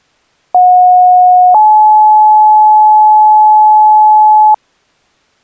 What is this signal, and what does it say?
Two-tone page, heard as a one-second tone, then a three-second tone, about 730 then 860 Hz.